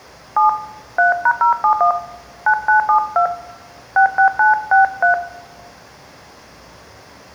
DTMF, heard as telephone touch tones, dialled by hand, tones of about 110 ms, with room echo. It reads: 7 3#071 9972 66963